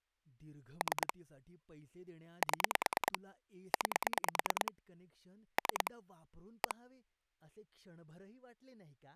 Pulse dialling, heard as clicks on a phone line, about 9 pulses a second, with speech in Marathi. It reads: 3 7 9 3 1